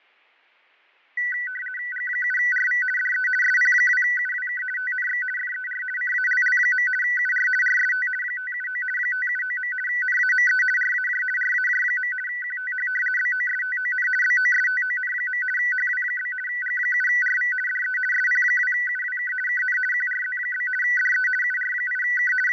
RTTY (50 baud, 450 Hz shift), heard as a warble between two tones, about 1750 Hz centre, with fading. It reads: G7RV DE SP2UWK TNX FER CALL. UR RST 579 579. NAME RAJ RAJ. QTH BOSTON BOSTON. HW? G7RV DE SP2UWK KN QRZ? DE UR8K …